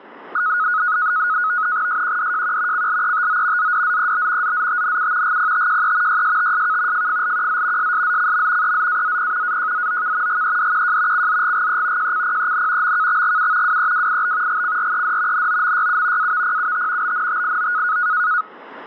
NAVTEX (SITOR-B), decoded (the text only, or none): SQDJQ CLETO ZDZEB ZZTNU GPTJE YSTSK FFLQZ SSZCM EZAZP AJZOK GEDQJ CZGGE JCPEN MKXGU WEWIB GCRED NOMYU AVPUT BNTIO